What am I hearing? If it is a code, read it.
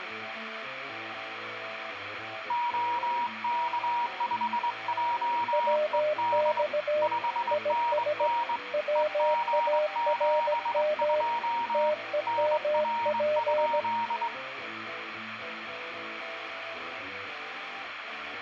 Morse code, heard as two keyed tones, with radio static. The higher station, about 22 wpm, 950 Hz: OK5JED 5NN EG72 NR?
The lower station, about 17 wpm, 610 Hz: WX IS WARM TEMP